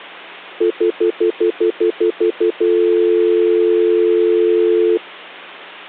Telephone call progress tone (North American plan), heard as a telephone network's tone, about 350, 440 Hz, 0.1 s on and 0.1 s off, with hum. Stutter dial tone.